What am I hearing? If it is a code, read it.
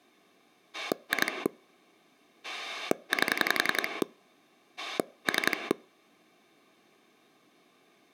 Pulse dialling, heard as a rotary dial, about 11 pulses a second. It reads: 2 8 3